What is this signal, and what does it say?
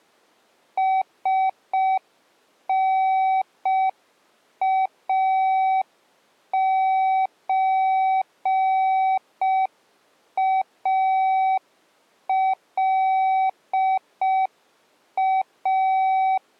Morse code (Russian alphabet), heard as a keyed tone, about 5 wpm, 760 Hz. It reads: СНАЧАЛА